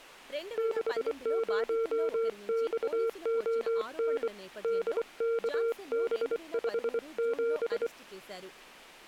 Morse code, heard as a keyed tone, hand-sent with a bug key, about 24 wpm, 460 Hz, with speech in Telugu. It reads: 60XON DKB57